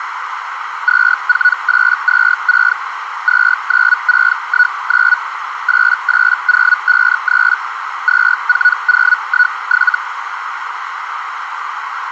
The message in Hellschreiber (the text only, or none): 24826 29619 88053 24017